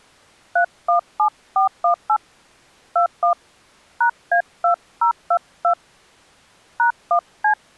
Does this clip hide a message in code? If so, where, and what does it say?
Yes: DTMF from 0.6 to 7.5 s, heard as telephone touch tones, dialled by hand, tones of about 100 ms. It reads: 317418 21 #A2022 #1C